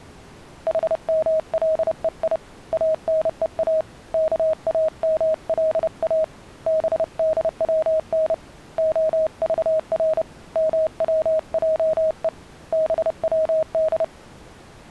Morse code (Persian alphabet), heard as a keyed tone, hand-sent with a paddle, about 30 wpm, 630 Hz. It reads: حملهی انها کاملا بدون عذر موجه بود